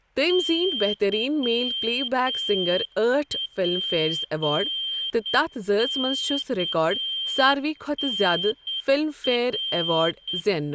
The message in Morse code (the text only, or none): YPKNR